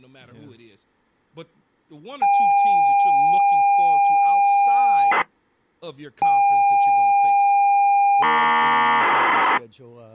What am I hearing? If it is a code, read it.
ZX Spectrum tape loading, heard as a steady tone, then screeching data, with speech in English.